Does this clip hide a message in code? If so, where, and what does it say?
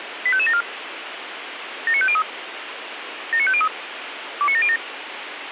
Yes: five-tone selective call (ZVEI) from 0.3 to 4.8 s, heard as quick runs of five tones, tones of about 70 ms, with radio hiss and a squelch burst at the end. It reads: 85574 79503 79503 29707